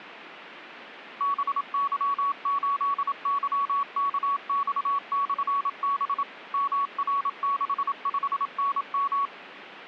Morse code, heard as a keyed tone, machine-sent, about 27 wpm, 1120 Hz. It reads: BY8YKX/B MR65NM